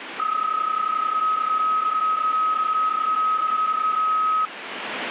PSK31 (31.25 baud), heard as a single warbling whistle, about 1270 Hz, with radio static.